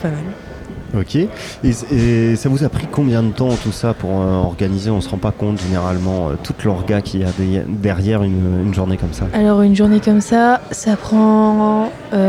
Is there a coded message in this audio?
No.